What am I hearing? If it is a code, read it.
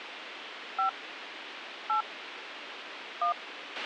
DTMF, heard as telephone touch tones, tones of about 110 ms, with radio hiss and a squelch burst at the end. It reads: 5 8 1